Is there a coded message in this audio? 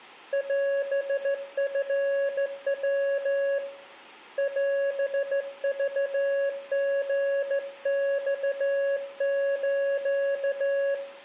Yes: Morse code (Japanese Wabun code) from 0.3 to 11.0 s, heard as a keyed tone, hand-sent with a straight key, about 14 wpm, 560 Hz, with room echo. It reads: オチヤ オクリマス